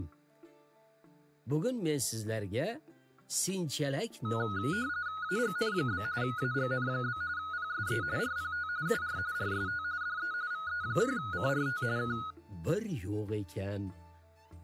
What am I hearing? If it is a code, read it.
RTTY (45.45 baud, 170 Hz shift), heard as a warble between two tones, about 1360 Hz centre. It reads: AGN? AGN? PSE RPT UR RST DE VE1CRT K